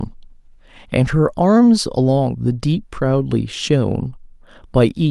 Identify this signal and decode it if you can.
Speech in English. There is no code.